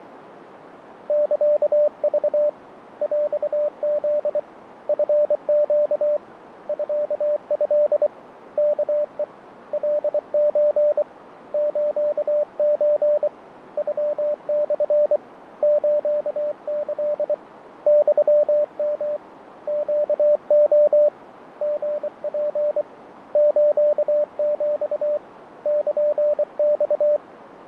Morse code (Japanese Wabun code), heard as a keyed tone, hand-sent with a paddle, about 24 wpm, 590 Hz, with radio static and fading. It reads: サク ヰフ チネ ミト ワヘ カソ スソ ノモ スキ ユヨ ネレ リツ スヒ ルマ